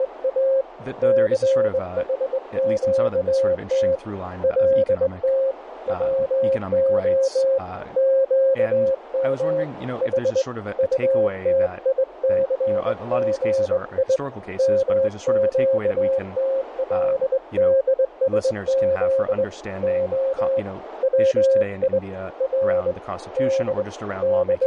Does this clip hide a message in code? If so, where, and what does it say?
Yes: Morse code (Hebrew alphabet) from 0.0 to 24.7 s, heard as a keyed tone, hand-sent with a straight key, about 21 wpm, 540 Hz, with radio static, a narrow filter and speech in English. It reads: … סחקת לת צה קם ח טתיסגי מקתלדשז ה צי ר ד …